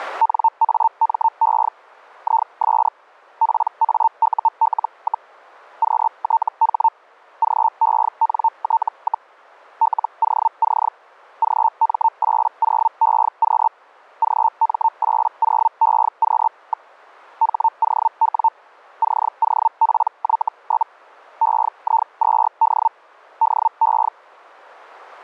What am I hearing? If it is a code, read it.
Hellschreiber (Feld-Hell, 122.5 baud), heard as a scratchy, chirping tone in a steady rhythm, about 900 Hz. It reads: NAME IS PAUL, QTH GENT, LOC GM80EQ GM80EQ. HOW COPY? EI2D DE